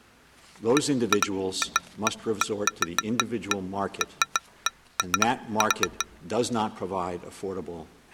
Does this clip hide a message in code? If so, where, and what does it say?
No, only irregular taps on glass.